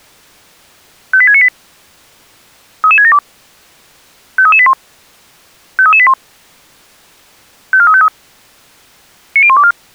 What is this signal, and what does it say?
Five-tone selective call (ZVEI), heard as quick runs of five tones, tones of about 70 ms. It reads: 58698 33672 53381 53381 54353 90124